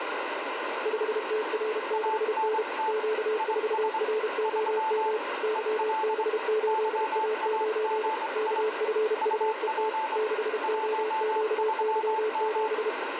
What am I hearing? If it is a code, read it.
Morse code, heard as two keyed tones, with heavy radio static. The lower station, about 32 wpm, 430 Hz: 5TR6N Q4ROM YB8A9 KFUET 6OQY7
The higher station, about 24 wpm, 880 Hz: ANT IS 3 EL YAGI UP 13M